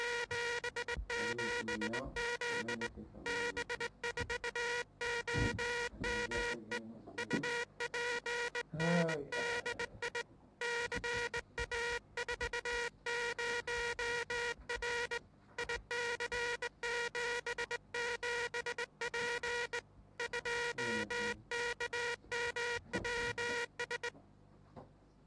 Morse code, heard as a buzzer, hand-sent with a straight key, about 20 wpm. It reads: … B4OME UPNDI CA40R IC77P 2KMWS